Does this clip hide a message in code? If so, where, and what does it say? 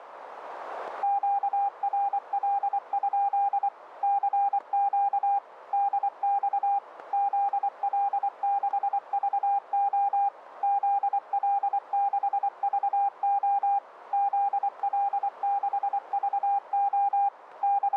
Yes: Morse code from 1.0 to 18.0 s, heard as a keyed tone, machine-sent, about 24 wpm, 800 Hz, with radio static. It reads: QRL? CQ DX ZL6VO ZL6VO ZL6VO …